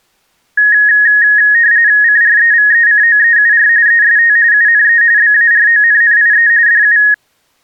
RTTY (45.45 baud, 170 Hz shift), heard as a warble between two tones, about 1750 Hz centre. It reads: CREVECOEUR EST UNE BARONNIE DU